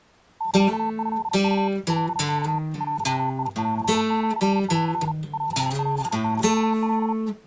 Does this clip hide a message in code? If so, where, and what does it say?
Yes: Morse code (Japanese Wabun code) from 0.3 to 7.2 s, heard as a keyed tone, machine-sent, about 37 wpm, 890 Hz. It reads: サトウ カワ デンシン オオサカ